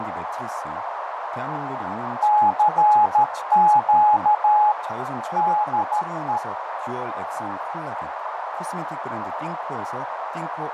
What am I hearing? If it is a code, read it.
Morse code, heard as a keyed tone, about 13 wpm, 840 Hz, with heavy radio static, fading, a narrow filter and speech in Korean. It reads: CQ DE